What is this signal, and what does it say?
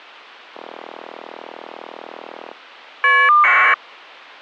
Caller ID data burst, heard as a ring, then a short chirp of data, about 1200 baud.